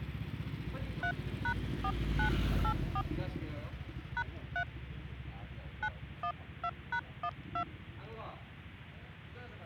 DTMF, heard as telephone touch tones, dialled by hand, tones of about 70 ms, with the noise of a residential street. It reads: 3#4984 #3 912#12